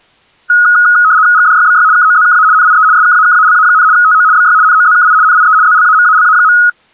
RTTY (75 baud, 170 Hz shift), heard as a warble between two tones, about 1360 Hz centre. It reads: GDYBY KOZKA NIE SKAKALA, TO BY NOZKI NIE ZLAMALA.